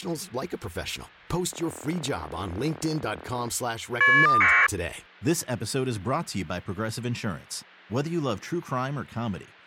Caller ID data burst, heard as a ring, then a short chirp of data, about 1200 baud, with speech in English.